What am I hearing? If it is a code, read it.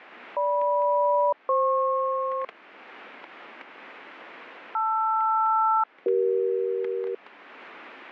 Aircraft SELCAL, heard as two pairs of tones, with static crashes. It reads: GM-FP LR-CE